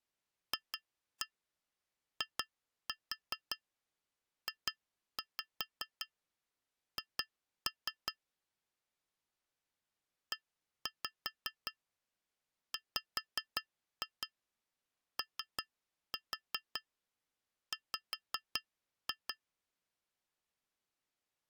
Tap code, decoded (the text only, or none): FIJH EWOW